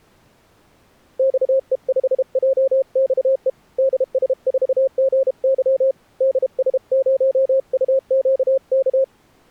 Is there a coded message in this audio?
Yes: Morse code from 1.1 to 9.1 s, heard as a keyed tone, hand-sent with a paddle, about 32 wpm, 530 Hz. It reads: XE5JXE DS4GY DS0UQK